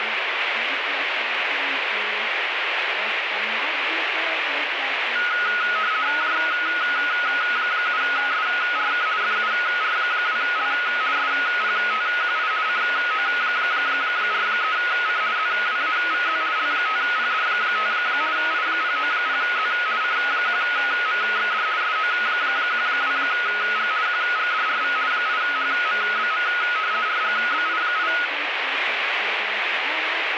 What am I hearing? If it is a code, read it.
RTTY (50 baud, 170 Hz shift), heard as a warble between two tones, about 1360 Hz centre, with radio static. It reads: J7SRK FUR2L SPTQI CO43C ZWAVZ L5PD5 I090Z C1MXD SO12G QGDRV 8HMBM RGBI8